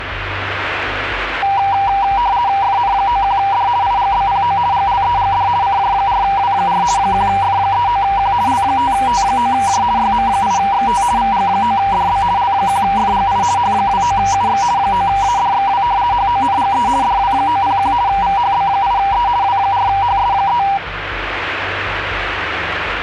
RTTY (50 baud, 170 Hz shift), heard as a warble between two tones, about 880 Hz centre, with radio static. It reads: FN91D IGBPO GLEGD CJ4W4 1F39Q L5T9J YM8XT VG9DB L1FGI H29UX 9ADXW HONGE DW901 VHB8E W4HS3